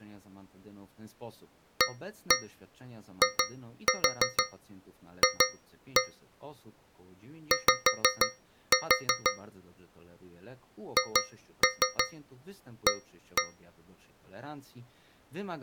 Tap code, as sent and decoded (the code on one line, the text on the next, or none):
1-1 2-4 2-1 / 5-4 / 2-3 1-1
AIF Y HA